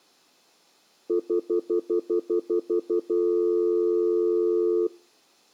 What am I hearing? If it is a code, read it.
Telephone call progress tone (North American plan), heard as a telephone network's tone, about 350, 440 Hz, 0.1 s on and 0.1 s off. Stutter dial tone.